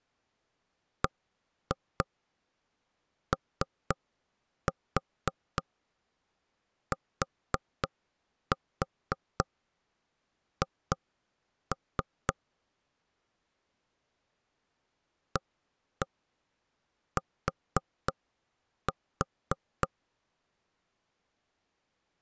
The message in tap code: BOTH AT

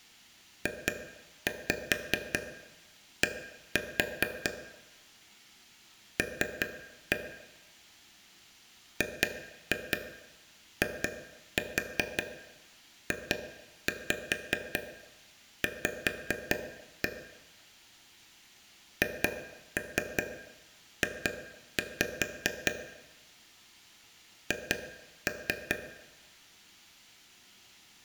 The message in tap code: JD L GIJV HJ H

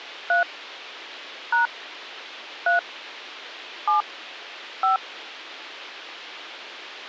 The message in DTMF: 3 # 3 7 5

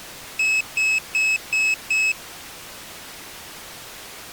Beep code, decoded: 5 short

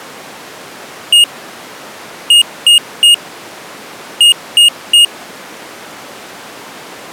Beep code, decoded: 1-3-3

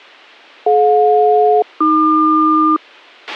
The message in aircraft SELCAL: DJ-AQ

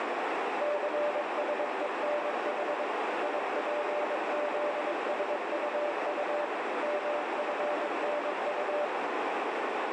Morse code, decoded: CSENH IPZSUU MFNU

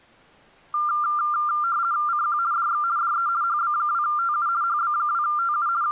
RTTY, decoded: CQ DX DE HB2TU HB2TU …

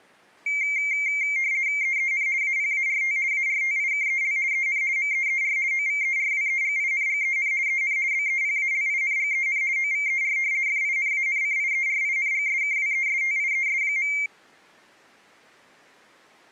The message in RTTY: EEN APART ARTIKEL EN MEER OVERWEGINGEN EN BEPALINGEN OVER FINANCIERINGSKWESTIES.

